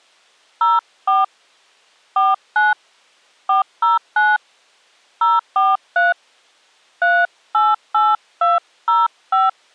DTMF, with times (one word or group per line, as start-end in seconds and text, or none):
0.6-1.2 04
2.2-2.7 49
3.5-4.4 409
5.2-6.1 043
7.0-9.5 388205